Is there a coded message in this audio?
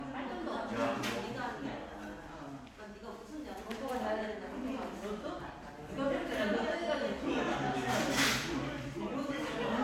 No, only the noise of a crowd indoors.